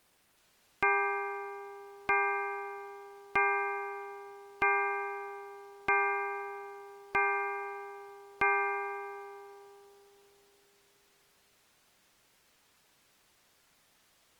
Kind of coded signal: clock strike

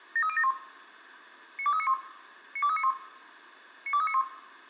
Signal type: five-tone selective call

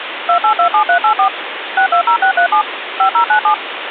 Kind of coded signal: DTMF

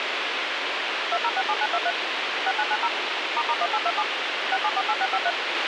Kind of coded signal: DTMF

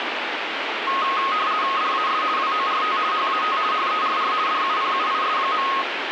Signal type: RTTY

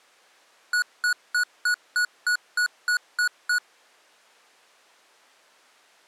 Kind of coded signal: beep code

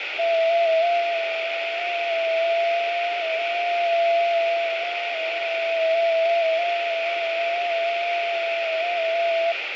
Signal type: FT8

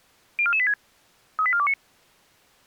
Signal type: five-tone selective call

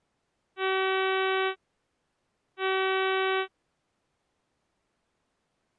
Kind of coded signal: ship horn signal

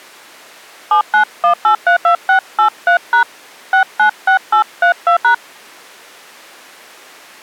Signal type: DTMF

